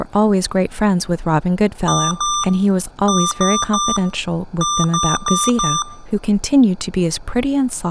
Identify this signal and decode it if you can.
Beep code, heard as beeps from a small speaker, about 1190 Hz, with room echo and speech in English. 2-3-4.